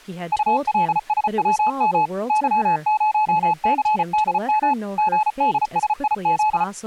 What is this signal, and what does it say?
Morse code, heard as a keyed tone, machine-sent, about 34 wpm, 860 Hz, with speech in English. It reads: ULSWM Y0CDM GDSIZ